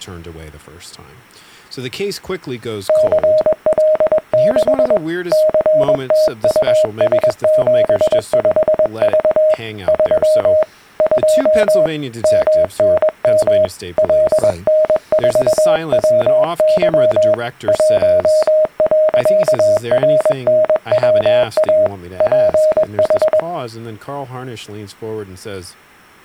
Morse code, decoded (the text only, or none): CL6 CTUS75V 3 2 MNM LN4WY 1.RNWA PH